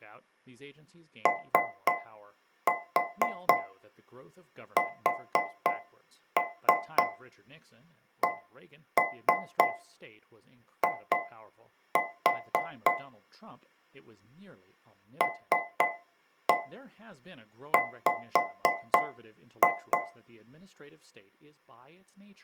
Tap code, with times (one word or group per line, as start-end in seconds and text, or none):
1.3-12.9 OSCI
15.2-20.0 LW